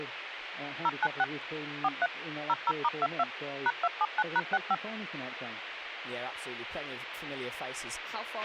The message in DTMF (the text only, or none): 096 43 00*22 #279#65